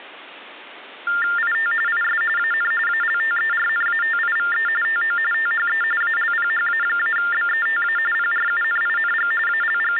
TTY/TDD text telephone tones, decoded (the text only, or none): IT IS AN ALTERNATIVE TO THE ALPHA-BETA PRUNING …